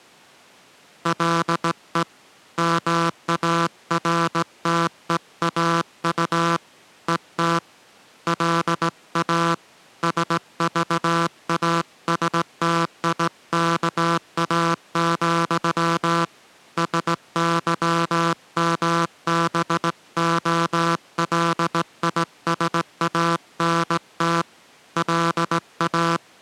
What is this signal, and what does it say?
Morse code, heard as a buzzer, hand-sent with a straight key, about 17 wpm. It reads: LE MARTEAU ET LA SVASTIKA, SYMBOLISANT LA